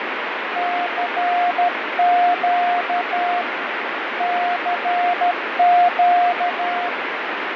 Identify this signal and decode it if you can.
Morse code, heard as a keyed tone, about 13 wpm, 710 Hz, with heavy radio static and fading. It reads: CQ CQ